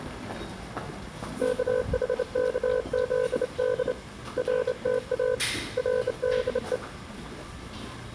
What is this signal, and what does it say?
Morse code, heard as a keyed tone, hand-sent with a straight key, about 27 wpm, 500 Hz, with the noise of a subway station. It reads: KHKZD RTA RDE